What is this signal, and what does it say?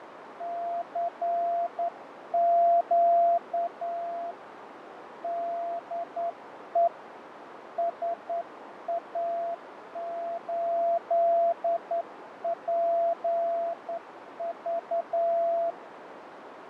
Morse code, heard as a keyed tone, hand-sent with a straight key, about 10 wpm, 680 Hz, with radio static, fading and a narrow filter. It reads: CQ DE SA8PV